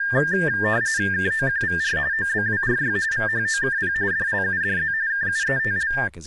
RTTY (45.45 baud, 170 Hz shift), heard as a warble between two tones, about 1700 Hz centre, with speech in English. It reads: KOQVR OBWRY VHOKP DLUDZ KUETL